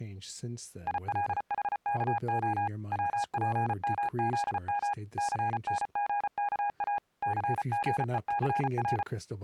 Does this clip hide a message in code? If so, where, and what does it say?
Yes: Morse code (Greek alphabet) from 0.8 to 9.1 s, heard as a keyed tone, machine-sent, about 34 wpm, 820 Hz, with speech in English. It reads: ΙΛΗΚΟ ΩΠΜΖΜ ΘΝΓΚΑ ΘΓΕΘΡ